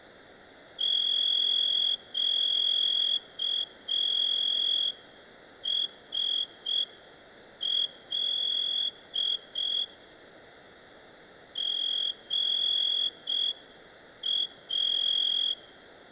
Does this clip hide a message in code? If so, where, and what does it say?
Yes: Morse code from 0.7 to 15.6 s, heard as a whistle, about 5 wpm, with room echo. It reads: QSL GA